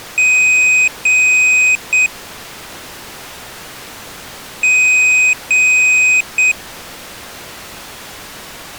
Beep code, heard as a piezo beeper, played twice, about 2500 Hz. 2 long, 1 short.